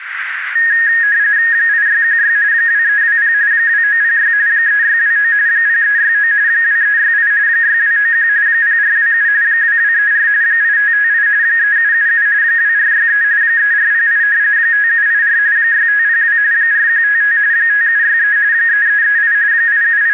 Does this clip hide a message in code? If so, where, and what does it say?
Yes: RTTY (45.45 baud, 170 Hz shift) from 0.6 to 20.1 s, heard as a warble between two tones, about 1750 Hz centre, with radio static and a narrow filter. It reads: 8616 2320 2906 3629 0369 2368 6291 0427 2234 8558 3777 2463 3408 5784 6502 4155 5763 3338 …